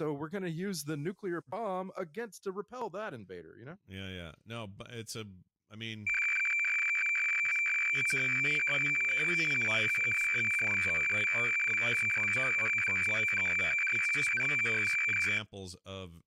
Weather fax (radiofax), 120 lines a minute, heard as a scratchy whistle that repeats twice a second, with speech in English.